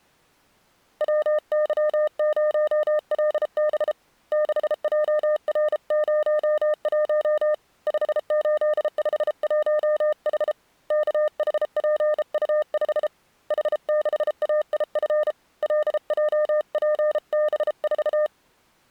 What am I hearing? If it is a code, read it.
Morse code, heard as a keyed tone, hand-sent with a bug key, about 33 wpm, 610 Hz. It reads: WY0LB 6JR01 5851H KHPU5 H6AIF LJPB4